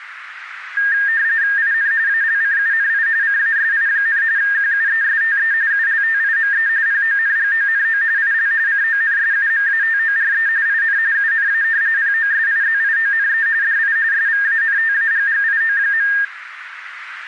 RTTY (45.45 baud, 170 Hz shift), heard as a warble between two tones, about 1700 Hz centre, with radio static. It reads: IN ALCUNI CASI, QUESTE ULTIME PONGONO IL CONSUMATORE IN UNA POSIZIONE DI SVANTAGGIO.